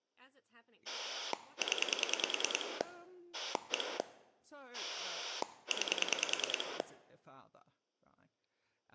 Pulse dialling, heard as a rotary dial, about 10 pulses a second, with speech in English. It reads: 0 1 9